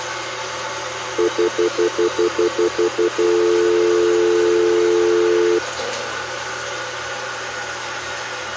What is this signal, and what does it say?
Telephone call progress tone (North American plan), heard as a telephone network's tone, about 350, 440 Hz, 0.1 s on and 0.1 s off, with hum and the noise of a restroom. Stutter dial tone.